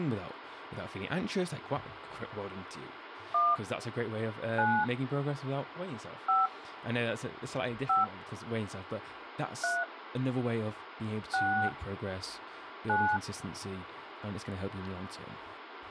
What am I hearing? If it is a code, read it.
DTMF, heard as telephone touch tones, dialled by hand, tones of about 280 ms, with phone line noise and speech in English. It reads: 1 9 5 5 3 6 9